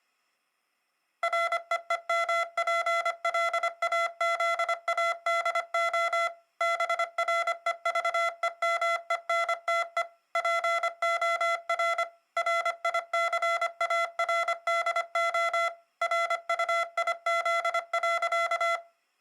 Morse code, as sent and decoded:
.-. . . -- .--. .-.. .- --.. .- -.. --- / -... .-. . ...- . -- . -. - . / .--. --- .-. / .-. .. -.-. .- .-. -.. --- / .-. ..- .. --.. .-.-.-
REEMPLAZADO BREVEMENTE POR RICARDO RUIZ.

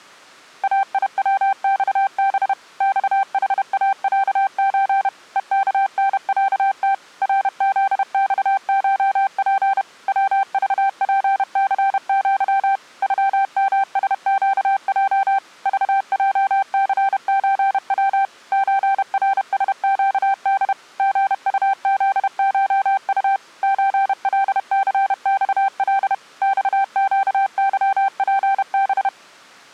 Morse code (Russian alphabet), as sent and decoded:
.- .. .-- -..- -... / -..- .... .- .-.- ---. / . -.- -. .-.- - / .-. --.. -..- ---- .--. / .-- ...- .--. -.-. --.-- / ..-- -- ... --.- .--- / ...- .--- -.-. ---. .-- / ---. .-. ... --.- -.. / --. ..- --.. ---- ..- / ---. .-.. -.-. -..- .-.. / -..- --.- -.-- .--. -...
АИВЬБ ЬХАЯЧ ЕКНЯТ РЗЬШП ВЖПЦЪ ЮМСЩЙ ЖЙЦЧВ ЧРСЩД ГУЗШУ ЧЛЦЬЛ ЬЩЫПБ

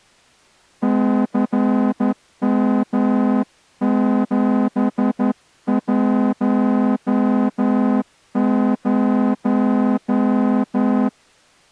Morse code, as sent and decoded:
-.-. -- --... .---- -----
CM710

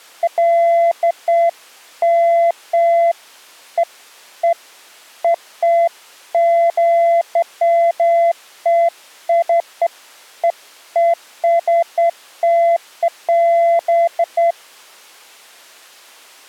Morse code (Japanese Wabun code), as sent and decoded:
none

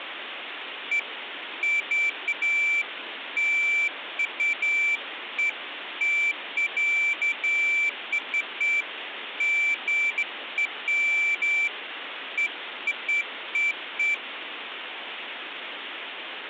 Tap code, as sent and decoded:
none

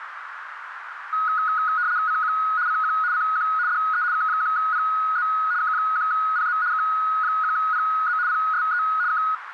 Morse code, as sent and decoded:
none

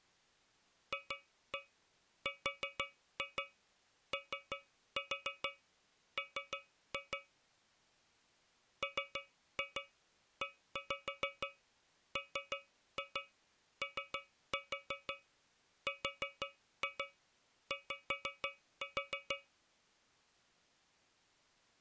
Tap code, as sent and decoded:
2-1 4-2 3-4 3-2 / 3-2 1-5 3-2 3-4 4-2 5-4
FROM MEMORY

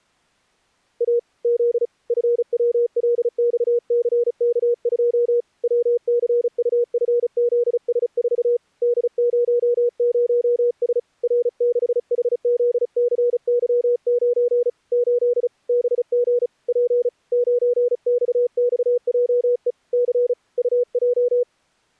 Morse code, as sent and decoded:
.- / --.. / ..-. .-- .-.. -..- -.-. -.- ..--- / .-- -.-. ..- ..-. --.. ... ....- / -.. ----- ----- ... / .-. -.... .... --.. -.-. -.-- ----. / ---.. / -... --. / .--. / ----. -..- -..- .--- . / -.-. / ..- .---
A Z FWLXCK2 WCUFZS4 D00S R6HZCY9 8 BG P 9XXJE C UJ

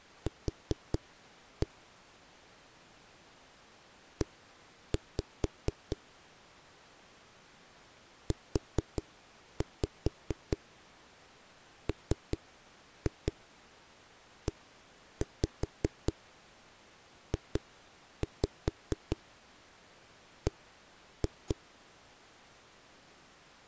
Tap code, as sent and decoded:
4-1 / 1-5 / 4-5 3-2 1-5 2-5 1-2
Q E UMEJB

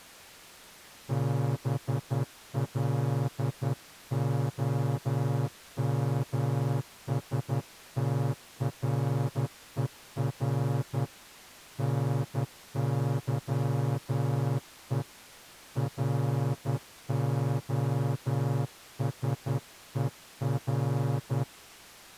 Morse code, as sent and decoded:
-... .-.. --- -- ... - .-. . .-. / -. -.-- . / .-. --- ... . .-.
BLOMSTRER NYE ROSER

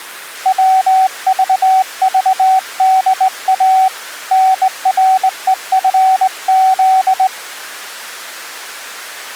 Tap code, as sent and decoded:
none

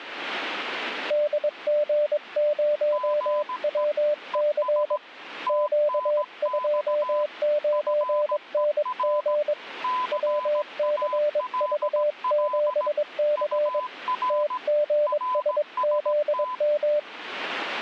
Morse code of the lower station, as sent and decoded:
-.. --. ----- .-- -.-. / --.- ..--- ----. -. --. / .-- -.-. ...- --... -.-. / - --. ... --.. --
DG0WC Q29NG WCV7C TGSZM

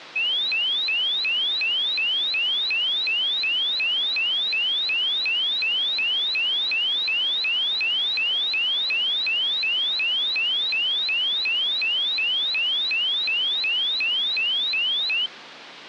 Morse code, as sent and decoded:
none

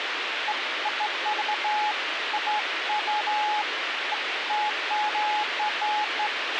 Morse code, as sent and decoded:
none

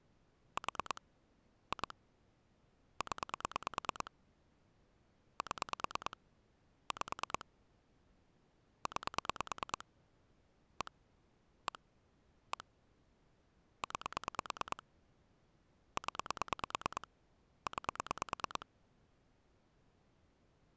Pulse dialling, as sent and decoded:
4 / 2 / 10 / 7 / 5 / 9 / 1 / 1 / 1 / 9 / 10 / 9
4 2 0 7 5 9 1 1 1 9 0 9

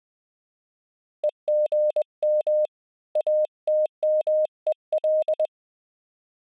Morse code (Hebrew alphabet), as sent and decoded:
. --. -- / .- - -- . .-..
וגם אתמול

